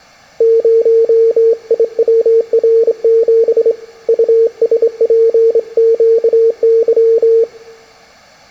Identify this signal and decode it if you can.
Morse code, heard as a keyed tone, hand-sent with a straight key, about 27 wpm, 450 Hz, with room echo. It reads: 0IWR7 USPQY